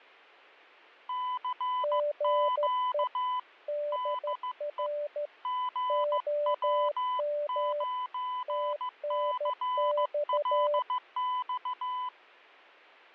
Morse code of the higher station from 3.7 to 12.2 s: DE GW9CLX

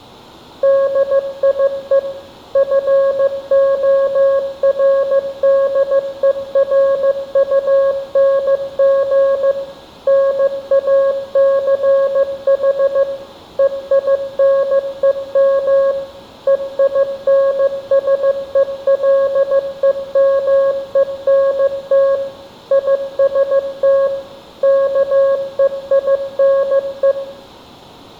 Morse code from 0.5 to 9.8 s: DIE FORDERUNG

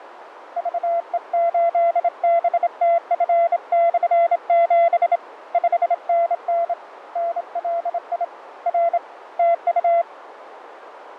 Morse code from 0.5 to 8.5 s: VE8BTF/7 5NN NLI

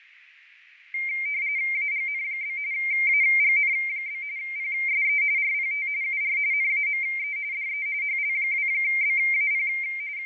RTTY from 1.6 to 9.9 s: AGN? AGN? PSE RPT UR NAME DE HL2BAP

